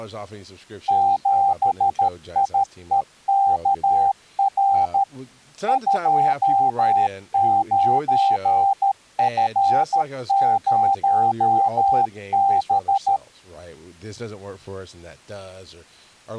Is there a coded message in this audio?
Yes: Morse code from 0.8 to 13.2 s, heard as a keyed tone, machine-sent, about 13 wpm, 790 Hz, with speech in English. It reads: 7IEKR 29F0B